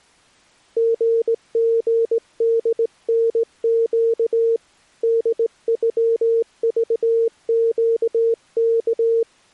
Morse code (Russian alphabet), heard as a keyed tone, hand-sent with a straight key, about 19 wpm, 460 Hz. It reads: ГГДНЩ ДЮЖЩК